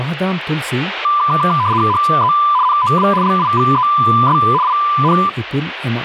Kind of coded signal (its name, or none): RTTY